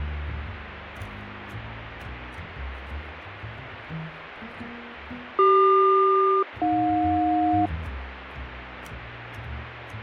Aircraft SELCAL, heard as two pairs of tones, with radio static. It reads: CQ-AJ